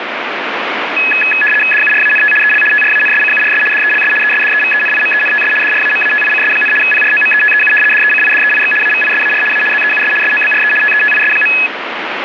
RTTY (75 baud, 850 Hz shift), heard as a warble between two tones, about 2100 Hz centre, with radio static. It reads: DURANT EL TRANSCURS DELS ESDEVENIMENTS DRAMATICS, PROMETEU DECIDEIX AVISAR A ZEUS SOBRE TETIS.